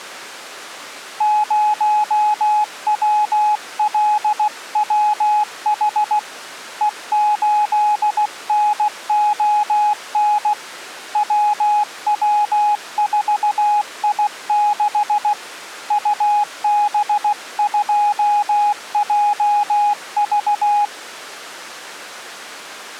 Morse code, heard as a keyed tone, hand-sent with a paddle, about 16 wpm, 840 Hz. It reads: 0WLWH E8NON WW4I6 UB2JV